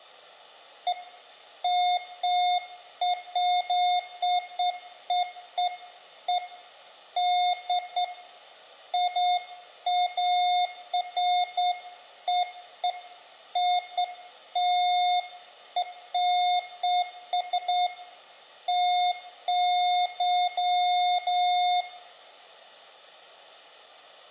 Beeps of irregular length, with room echo. There is no code.